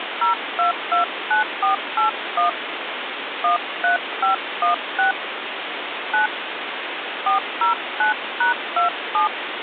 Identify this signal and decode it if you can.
DTMF, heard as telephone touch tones, dialled by hand, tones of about 120 ms, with phone line noise. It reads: 0229481 13516 9 409#27